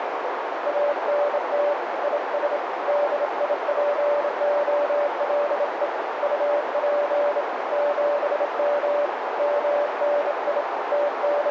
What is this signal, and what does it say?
Morse code, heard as a keyed tone, hand-sent with a bug key, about 27 wpm, 580 Hz, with heavy radio static and a narrow filter. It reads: ANT IS DIPOLE UP 7M MNI …